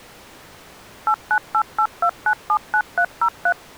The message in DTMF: 89882979303

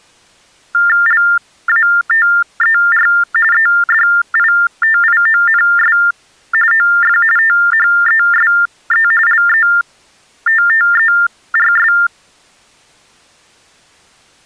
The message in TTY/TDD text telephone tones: LATER EDITIONS OF THESE LETTERS

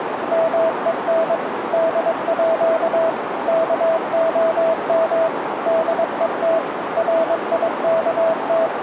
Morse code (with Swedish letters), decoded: MEN DÅ KOM DET …

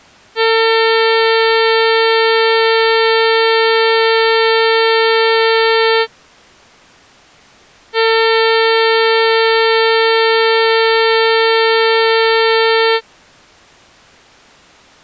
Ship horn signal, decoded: 2 long

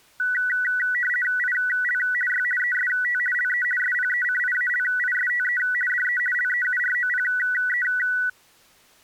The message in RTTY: IL Y EST LE SPECIALISTE DE LEUROPE

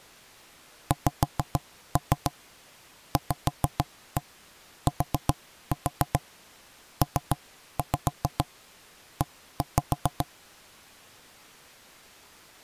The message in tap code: XVTPE

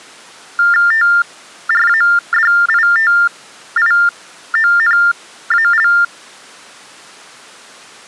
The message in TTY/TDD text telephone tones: TRADITIONAL

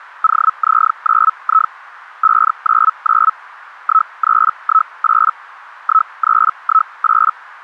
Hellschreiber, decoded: OZ9I 599 1318 1318

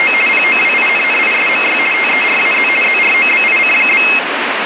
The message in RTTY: … POWINNISMY TERAZ ZROBIC?

